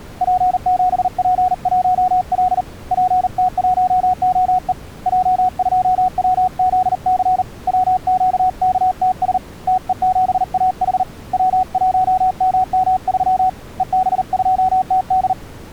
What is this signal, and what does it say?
Morse code, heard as a keyed tone, hand-sent with a paddle, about 39 wpm, 740 Hz. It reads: P7P1L PT1OE J2WZC WQKTS TE7AH W1MM3 EB2TD